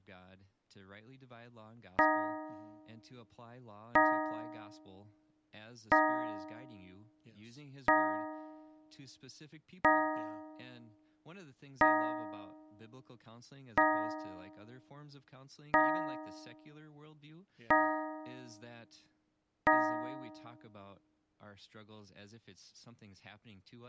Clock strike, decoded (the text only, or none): 10